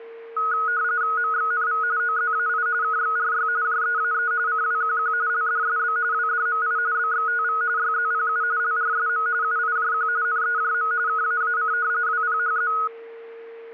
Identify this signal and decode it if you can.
RTTY (45.45 baud, 170 Hz shift), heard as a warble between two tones, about 1360 Hz centre, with a steady whistle near 460 Hz. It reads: MXNV OZAI KXRY JEAE CWQQ LDSB WDMI BXTV YZPU LRSM UIJQ NEJM KAAC WPHZ